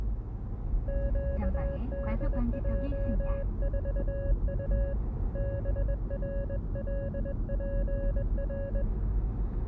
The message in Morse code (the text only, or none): QDJ4U BRLPR